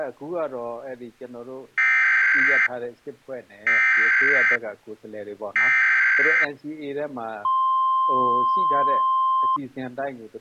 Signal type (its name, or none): Emergency Alert System (SAME) tones